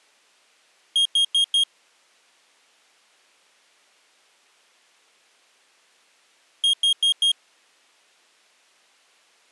Alarm pattern, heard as an alarm's beeps, played twice, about 3250 Hz. Temporal four. Carbon monoxide.